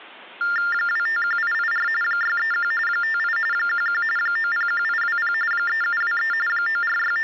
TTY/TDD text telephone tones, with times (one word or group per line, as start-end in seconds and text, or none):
0.7-1.9 251884
2.0-2.7 631
2.9-3.4 58
3.5-4.0 11
4.2-5.3 901820
5.5-6.3 3723
6.5-7.2 …